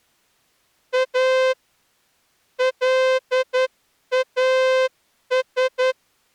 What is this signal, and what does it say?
Morse code, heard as a horn, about 10 wpm. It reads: A LAS